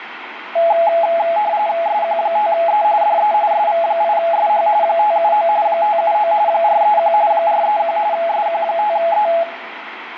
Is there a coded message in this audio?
Yes: RTTY (45.45 baud, 170 Hz shift) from 0.6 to 9.4 s, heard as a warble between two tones, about 760 Hz centre, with radio static and room echo. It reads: SQ5E DE SV8SH 579 579 431 431 SQ5E